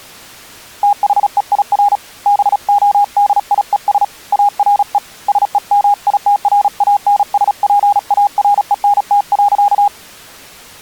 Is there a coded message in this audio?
Yes: Morse code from 0.8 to 9.9 s, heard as a keyed tone, hand-sent with a paddle, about 36 wpm, 820 Hz. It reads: THEIR BODIES ARE SEMITRANSPARENT.